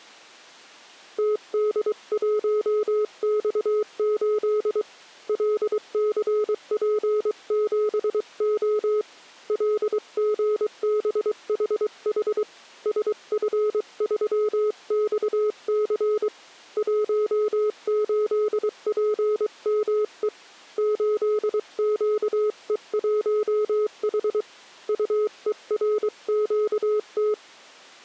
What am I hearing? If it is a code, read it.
Morse code, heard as a keyed tone, hand-sent with a paddle, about 23 wpm, 420 Hz. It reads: TD1X8 LCP7O LGBHH SF3XC 18PME 8QE1H UERQT